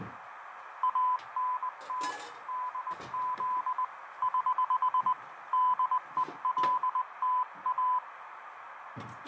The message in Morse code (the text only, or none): ANT DZ <HH> DELTA